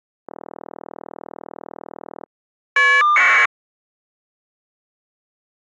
Caller ID data burst, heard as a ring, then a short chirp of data, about 1200 baud.